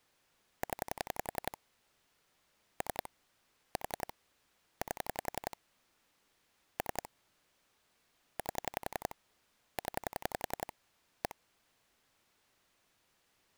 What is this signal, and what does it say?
Pulse dialling, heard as clicks on a phone line, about 11 pulses a second. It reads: 0 3 4 8 3 8 0 1